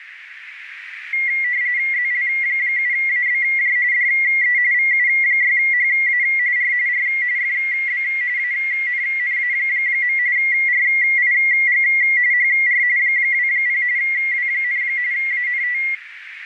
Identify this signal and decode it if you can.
RTTY (45.45 baud, 170 Hz shift), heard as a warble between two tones, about 2050 Hz centre, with radio static and a narrow filter. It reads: ZL7ABJ DE VU6HA R R FB ANNA. RIG HR 20 W, ANT